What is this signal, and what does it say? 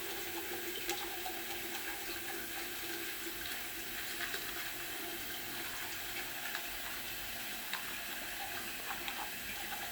The noise of a restroom. There is no code.